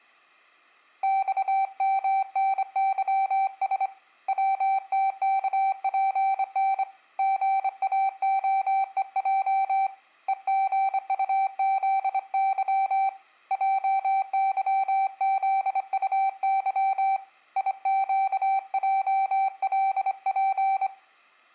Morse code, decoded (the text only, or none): XMNYS WTKPN GAOEJ EGUZY JYZUY IQJLP